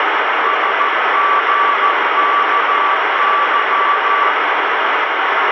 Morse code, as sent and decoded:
... --. -.- -.--
SGKY

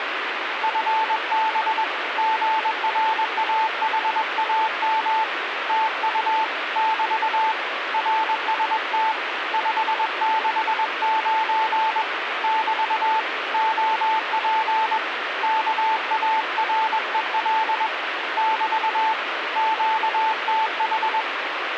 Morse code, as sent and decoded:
..-. -... / --. .-. .- .... .- -- / - ..- / -...- / .-. ... - / ..... -.... ----. / -...- / --- .--. / -.- .- .-. . .-.. / -...- / --.- - ....
FB GRAHAM TU <BT> RST 569 <BT> OP KAREL <BT> QTH

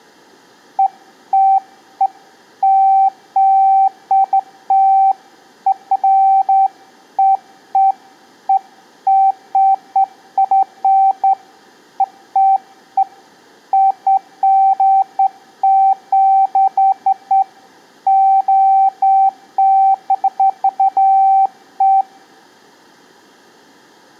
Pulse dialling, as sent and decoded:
none

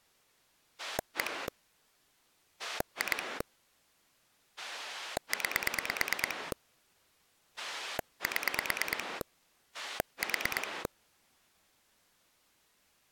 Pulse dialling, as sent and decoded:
1 / 2 / 9 / 7 / 4
1 2 9 7 4

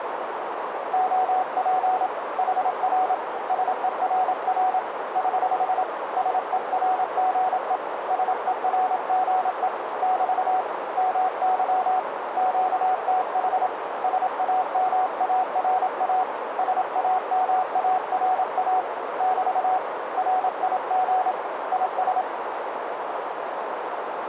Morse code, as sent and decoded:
--- .--. / .... .-. / ... . .-. .-. / ........ / ... . .-. --. . / ... . .-. --. . / -...- / -- -.-- / --.- - .... / ... .- -- .- .-. .- / ... .- -- .- .-. .- / -...- / .-. .. --. / .. ...
OP HR SERR <HH> SERGE SERGE <BT> MY QTH SAMARA SAMARA <BT> RIG IS

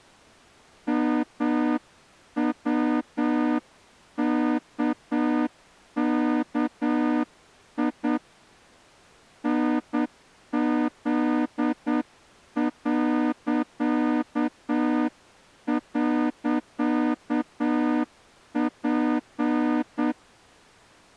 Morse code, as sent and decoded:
-- .-- -.- -.- .. / -. --.. .-.-.- .-.-.- .--.
MWKKI NZ..P

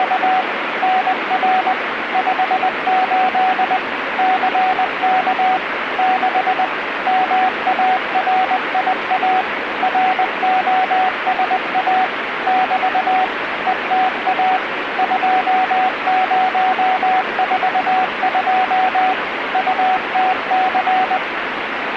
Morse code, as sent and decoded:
… / -. .-. / ..... ---.. / -.-. -.- / -.... / -- .- .-. .. .- / .-. --- ... .- / -...- / . - .- / ..--- ----- ....- ..--- / ..- - -.-.
… NR 58 CK 6 MARIA ROSA <BT> ETA 2042 UTC

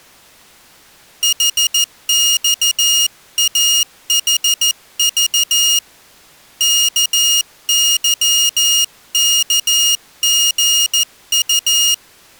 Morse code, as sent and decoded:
.... -..- .- .... ...- / -.- -.-- -.- --. ..-
HXAHV KYKGU

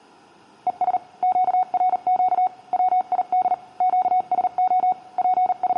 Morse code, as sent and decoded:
. ... / --.- .-. --.- / .-- .. -.. / --.- ... --- / …
ES QRQ WID QSO …

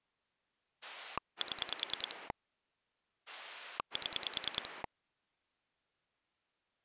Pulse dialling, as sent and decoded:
7 / 7
7 7

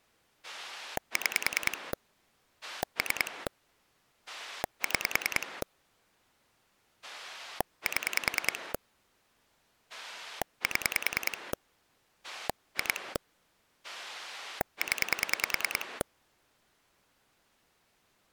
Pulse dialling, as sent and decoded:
6 / 3 / 6 / 7 / 7 / 2 / 10
6 3 6 7 7 2 0

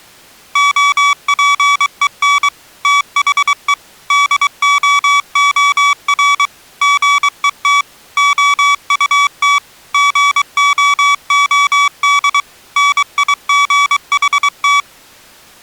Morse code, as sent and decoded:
--- .--. . -. / - .... . / -.. --- --- .-. / --. . - / --- ..- - / --. --- --- -.. / -. .. --. .... -
OPEN THE DOOR GET OUT GOOD NIGHT

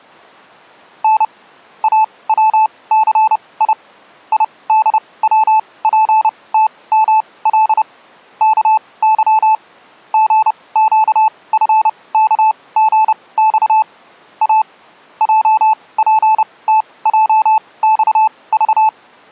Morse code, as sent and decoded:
-. / .- .-- -.-. .. / .. -.. .-- .--. - -- .-.. / -.- -.-- / --. --.- ..-. -.- --. -..- / .- / .--- .--. - .--- -..- ...-
N AWCI IDWPTML KY GQFKGX A JPTJXV

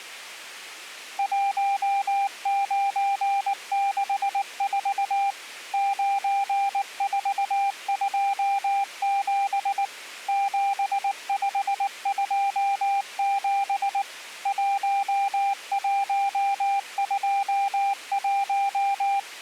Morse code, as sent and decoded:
.---- ----. -.... ....- / ----. ....- ..--- --... / --... ..... ..--- --... / .---- .---- ..--- .----
1964 9427 7527 1121

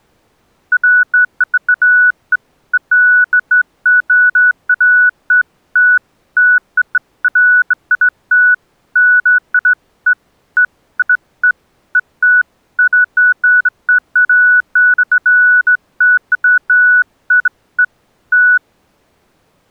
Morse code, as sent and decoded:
none

